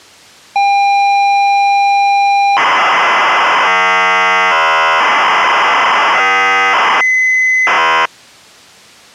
ZX Spectrum tape loading, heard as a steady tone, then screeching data.